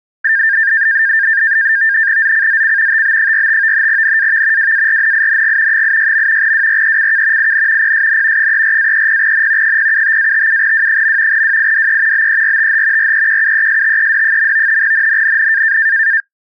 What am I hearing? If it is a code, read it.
NAVTEX (SITOR-B), 100 baud, 170 Hz shift, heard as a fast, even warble, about 1700 Hz centre. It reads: ZCZC TB45 NAV WARNING 86. WRECK IN PSN 34-30N 075-57W. WIDE BERTH REQUESTED. NNNN